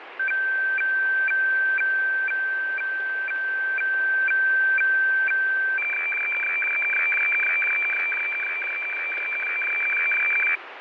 Weather fax (radiofax), 120 lines a minute, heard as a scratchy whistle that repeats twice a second, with radio static.